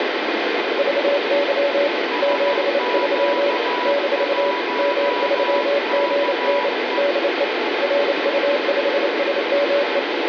Morse code, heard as two keyed tones, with heavy radio static. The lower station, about 28 wpm, 570 Hz: VY 73 - M3GN DE RU5SME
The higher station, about 14 wpm, 980 Hz: SQ1KE